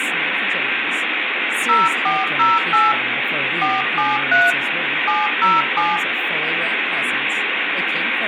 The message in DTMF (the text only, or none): 0408 473 707